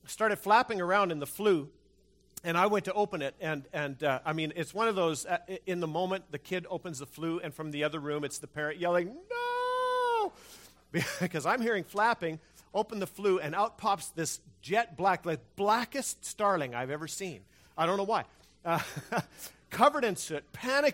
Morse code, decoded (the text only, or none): none